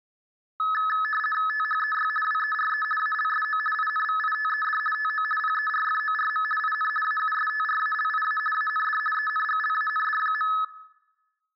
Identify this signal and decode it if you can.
RTTY (50 baud, 450 Hz shift), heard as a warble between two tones, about 1500 Hz centre, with room echo. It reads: THEY WERE ALSO INVITED TO PERFORM IN AUSTRALIA AND ENGLAND.